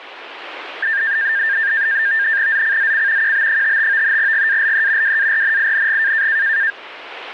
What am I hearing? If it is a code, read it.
NAVTEX (SITOR-B), 100 baud, 170 Hz shift, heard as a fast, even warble, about 1700 Hz centre, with radio static. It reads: ZCZC QB55 GALE WARNING